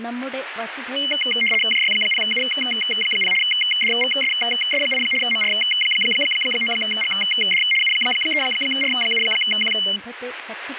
RTTY (75 baud, 850 Hz shift), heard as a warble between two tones, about 2550 Hz centre, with radio static and speech in Malayalam. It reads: JY0U0 DVSS8 MR9GD U3R7Q